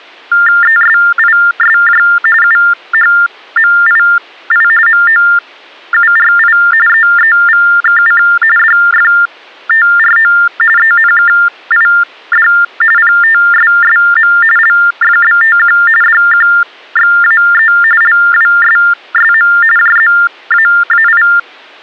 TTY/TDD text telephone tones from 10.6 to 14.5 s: ENKID PTSSM

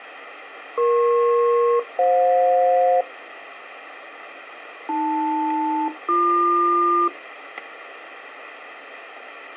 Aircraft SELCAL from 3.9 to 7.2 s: AL-BQ

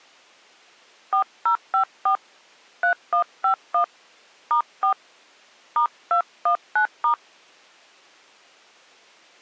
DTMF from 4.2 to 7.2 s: *4 *219*

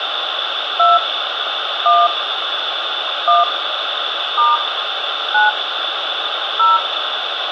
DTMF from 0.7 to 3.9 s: 2 1 1

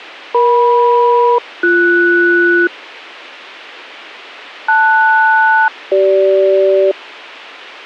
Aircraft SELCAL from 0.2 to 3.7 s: EM-BS

